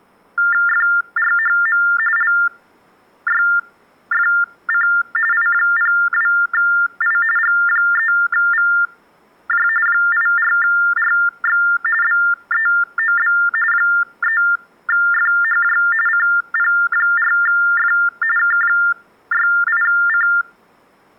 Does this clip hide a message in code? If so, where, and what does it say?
Yes: TTY/TDD text telephone tones (45.45 baud Baudot) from 0.4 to 20.4 s, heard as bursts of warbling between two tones, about 400 Hz shift, 1600 Hz centre. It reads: FRHM LYFC I02I G3VJ 84RX BEOB 3FHJ CP4F K68C